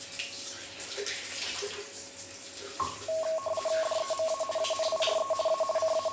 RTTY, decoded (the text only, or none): DEMA ANIRE A …